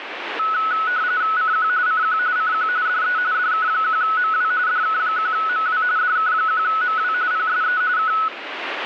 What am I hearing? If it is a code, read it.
RTTY (45.45 baud, 170 Hz shift), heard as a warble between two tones, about 1380 Hz centre, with radio static. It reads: CQ CQ CQ DE DK1MW DK1MW DK1MW PSE K